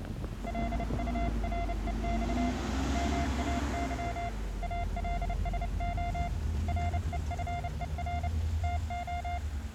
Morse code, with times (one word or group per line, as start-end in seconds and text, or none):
0.5-2.5 LUREX
2.9-4.3 MAY
4.6-6.3 ALSO
6.7-8.3 REFER
8.6-9.4 TO